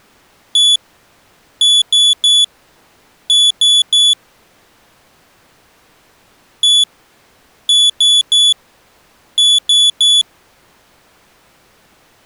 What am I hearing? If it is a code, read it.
Beep code, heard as a piezo beeper, played twice, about 3450 Hz. 1-3-3. In Phoenix BIOS tables: chip or data line failure in the first 64 KB of memory.